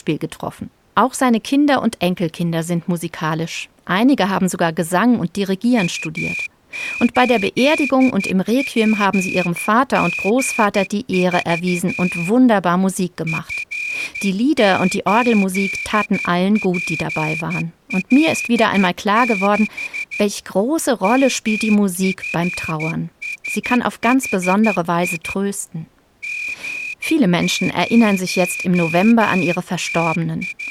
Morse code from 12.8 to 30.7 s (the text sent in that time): F8PL6 MFSHI …